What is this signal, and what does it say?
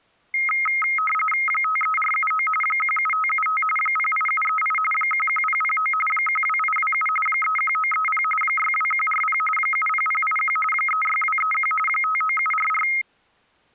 RTTY (45.45 baud, 850 Hz shift), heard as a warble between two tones, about 1700 Hz centre. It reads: 53479 17575 08738 11009 12827 31930 62140 70081 36231 59744